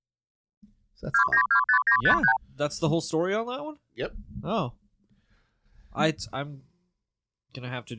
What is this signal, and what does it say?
Multi-frequency trunk signalling (R2, with the far end's replies), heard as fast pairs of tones, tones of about 90 ms, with speech in English. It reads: 2925953